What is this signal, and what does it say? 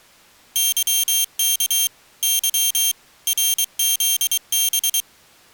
Morse code, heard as a high beeper, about 23 wpm, 3200 Hz. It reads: YK Y RZB